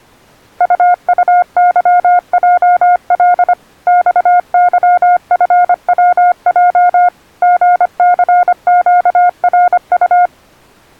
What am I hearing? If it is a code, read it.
Morse code, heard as a keyed tone, machine-sent, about 25 wpm, 710 Hz. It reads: UUYJL XYFWJ GCQRU